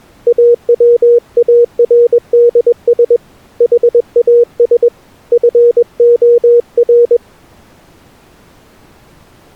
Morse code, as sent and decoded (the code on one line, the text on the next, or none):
.- .-- .- .-. -.. ... / .... .- ... / ..-. --- .-.
AWARDS HAS FOR